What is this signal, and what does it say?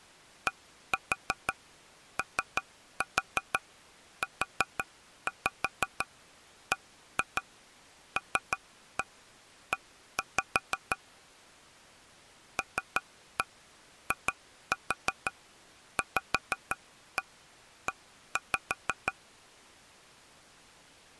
Tap code, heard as taps on a table, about 6 knocks a second. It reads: DOUBLE LIVE